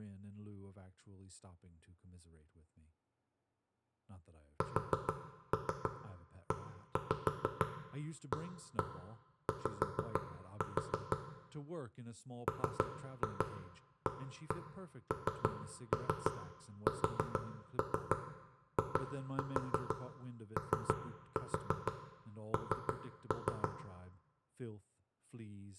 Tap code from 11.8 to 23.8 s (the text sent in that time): MANSION